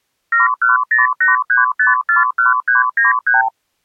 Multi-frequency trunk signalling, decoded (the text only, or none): 71083541393